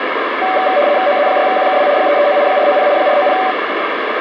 RTTY (75 baud, 170 Hz shift), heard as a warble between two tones, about 670 Hz centre, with radio static. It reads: OZ6QKW 339 490 490